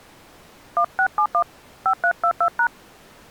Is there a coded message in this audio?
Yes: DTMF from 0.8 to 2.7 s, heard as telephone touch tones, dialled by hand, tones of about 80 ms. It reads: 1671 5322#